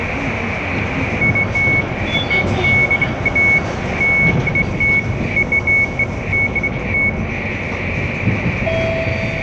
Beeps of irregular length, with radio static, room echo and the noise inside a bus. There is no code.